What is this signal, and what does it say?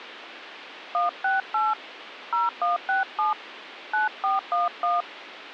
DTMF, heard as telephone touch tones, dialled by hand, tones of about 170 ms, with phone line noise. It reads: 168 0167 9411